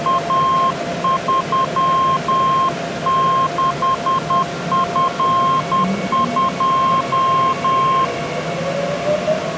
Morse code, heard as a keyed tone, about 10 wpm, 1060 Hz, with the noise inside a subway train. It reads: A36F2